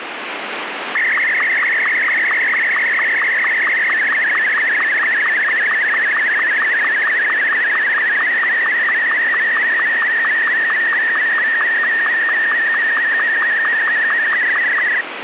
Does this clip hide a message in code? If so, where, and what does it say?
Yes: SSTV (slow-scan television), Martin M2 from 0.9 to 15.0 s, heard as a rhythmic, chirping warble, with radio static.